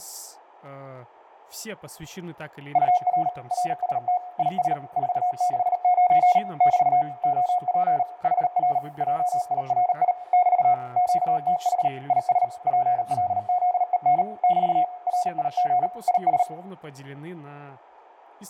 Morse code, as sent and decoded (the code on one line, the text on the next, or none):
..- .-. / .-. ... - / .. ... / ....- -.... ----. / -...- / --- .--. / .... .-. / .--- .. .-. .. / -...- / --.- - .... / .. ... / .--. .-.. --.. . -. / -...- / .-. .. --. / .. ...
UR RST IS 469 <BT> OP HR JIRI <BT> QTH IS PLZEN <BT> RIG IS